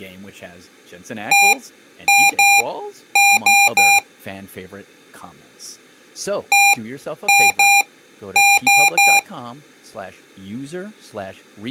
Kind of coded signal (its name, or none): beep code